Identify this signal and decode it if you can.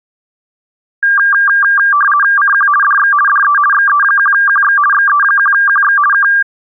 RTTY (50 baud, 450 Hz shift), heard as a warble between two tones, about 1390 Hz centre. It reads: CQ DX DE XE1QX XE1QX K